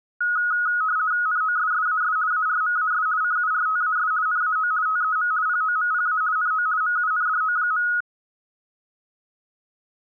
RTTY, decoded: NOSSAS ARMAS CURTAS NAO TEM POMPA NO MUNDO.

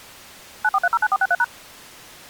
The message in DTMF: 94309463#

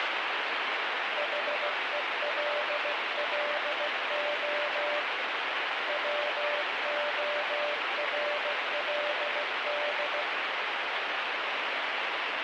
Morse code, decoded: HELLO WORLD

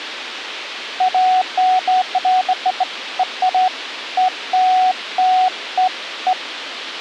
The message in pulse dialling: none

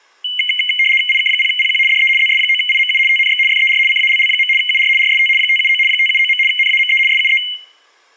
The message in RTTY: IK0PQ DE ZS9IMU TNX FER CALL. UR RST 579 579. NAME SUE

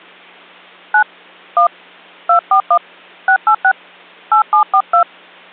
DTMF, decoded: 9 1 241 686 8742

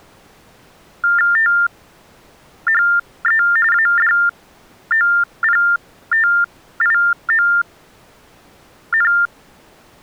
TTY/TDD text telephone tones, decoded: THE ADOPTION

